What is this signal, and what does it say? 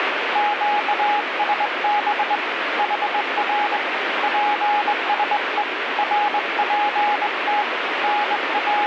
Morse code, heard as a keyed tone, hand-sent with a straight key, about 21 wpm, 830 Hz, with radio static. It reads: QSB HR PSE RPT …